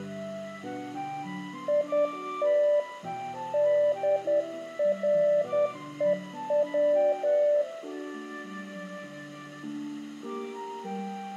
Morse code, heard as a keyed tone, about 10 wpm, 590 Hz, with room echo. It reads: IT DREW